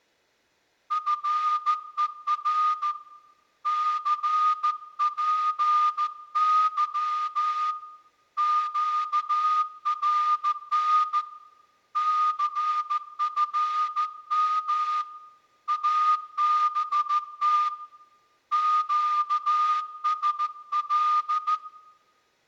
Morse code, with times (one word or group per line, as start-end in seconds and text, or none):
0.9-2.9 FER
3.7-7.7 CPY
8.4-11.2 QRN
12.0-15.0 CFM
15.7-17.7 ABT
18.5-21.6 QSL